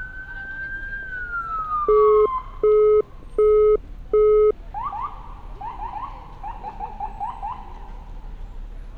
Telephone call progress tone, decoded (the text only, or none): busy tone